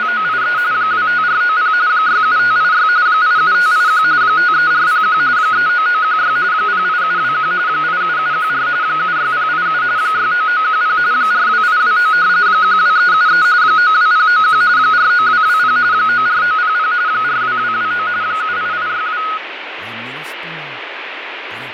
RTTY (45.45 baud, 170 Hz shift), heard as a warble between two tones, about 1360 Hz centre, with radio static and fading. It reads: … 25490 67586 87581 53401 39916 08721 87714 76087 69910 42829 12373 92091 49220 94900 42229 78862